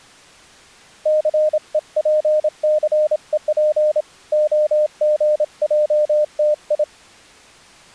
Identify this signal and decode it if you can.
Morse code (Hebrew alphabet), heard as a keyed tone, hand-sent with a paddle, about 27 wpm, 610 Hz. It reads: סוףסוף הגעתי